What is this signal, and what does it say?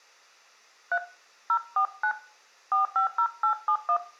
DTMF, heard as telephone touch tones, dialled by hand, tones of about 90 ms, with room echo. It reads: 3 049 450871